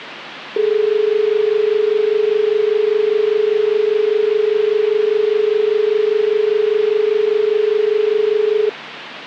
Telephone call progress tone (as in Australia), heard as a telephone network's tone, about 430 Hz, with phone line noise. Dial tone.